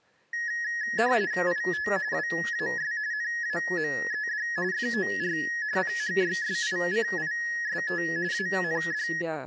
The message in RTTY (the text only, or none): IT WAS NAMED FOR PHYSICIST AND